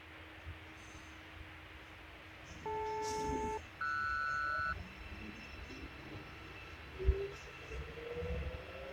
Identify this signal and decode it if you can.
Aircraft SELCAL, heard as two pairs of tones, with radio hiss and the noise inside a subway train. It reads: DL-RS